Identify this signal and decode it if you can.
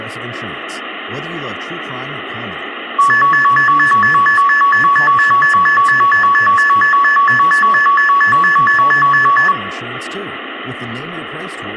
A tone that alternates evenly between two pitches, with phone line noise and speech in English. There is no code.